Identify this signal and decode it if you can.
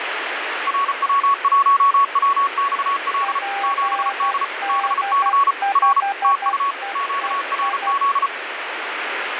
Morse code, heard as two keyed tones, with radio static. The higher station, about 34 wpm, 1120 Hz: RW1WXL 7D BC R TU QRZ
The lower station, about 12 wpm, 800 Hz: PD5EEI